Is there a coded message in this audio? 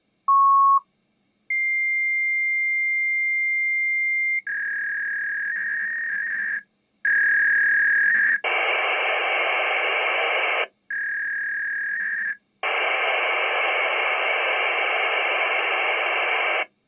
Yes: fax machine handshake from 0.3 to 16.6 s, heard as a beep, a long tone, a warble and hiss.